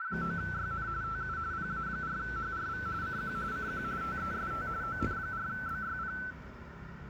RTTY (45.45 baud, 170 Hz shift), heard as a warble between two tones, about 1420 Hz centre, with radio static, a narrow filter and street noise. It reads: … TU PA4HRV CQ CQ TEST ON4BYP